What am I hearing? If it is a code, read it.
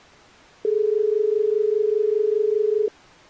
Telephone call progress tone (as in Australia), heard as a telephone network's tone, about 430 Hz. Dial tone.